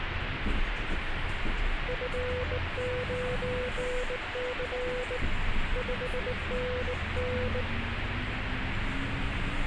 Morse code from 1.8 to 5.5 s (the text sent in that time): F9C